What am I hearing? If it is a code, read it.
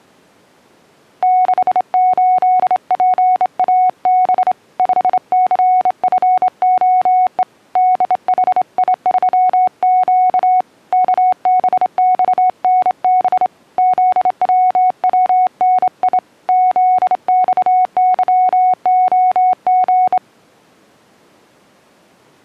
Morse code, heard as a keyed tone, hand-sent with a straight key, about 27 wpm, 740 Hz. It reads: 68PAB 5CFOE DHI3Q KBXNB ZWWNI ZXYOG